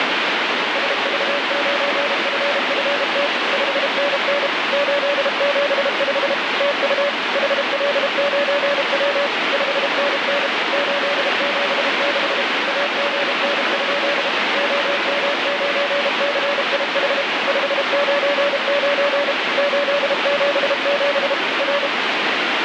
Morse code, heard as a keyed tone, machine-sent, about 32 wpm, 570 Hz, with heavy radio static. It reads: SV9FFT 5NN 875 TU HL9W 5NN 876 AGN? OM9CIH 599 877 R